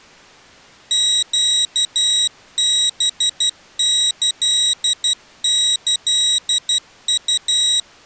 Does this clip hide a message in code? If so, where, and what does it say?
Yes: Morse code (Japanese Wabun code) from 0.9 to 7.9 s, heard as a high beeper, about 12 wpm, 3850 Hz. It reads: ネハキキウ